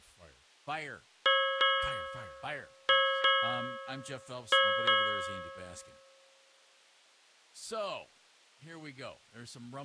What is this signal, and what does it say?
Ship's bell, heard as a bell, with speech in English. 6. Six half-hours of the watch have passed.